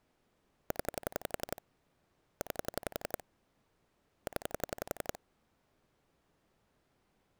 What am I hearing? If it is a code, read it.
Pulse dialling, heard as clicks on a phone line, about 11 pulses a second. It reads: 0 9 0